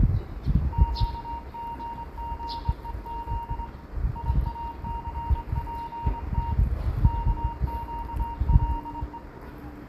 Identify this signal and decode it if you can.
Morse code, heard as a keyed tone, hand-sent with a straight key, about 23 wpm, 930 Hz, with room echo and the noise of a residential street. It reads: QGGEZ IACPT KQLE